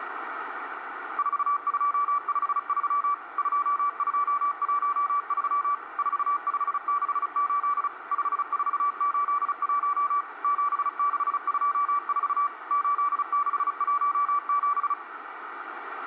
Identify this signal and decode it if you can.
Morse code, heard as a keyed tone, machine-sent, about 35 wpm, 1160 Hz, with radio static. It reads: 4253 2213 4568 5481 7624 8617